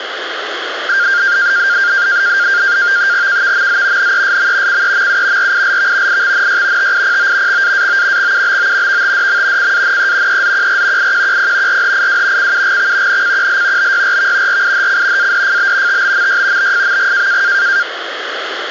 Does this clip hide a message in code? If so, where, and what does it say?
Yes: NAVTEX (SITOR-B), 100 baud, 170 Hz shift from 0.9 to 17.8 s, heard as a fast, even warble, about 1500 Hz centre, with radio static. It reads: KVMZ NESM CEMU RILV IXNY TIPO XAAO XUBO VTDM CANE EZQR IQQP RHIW CUGX NCQL BYRV RIHC ADFB TBMY BFMG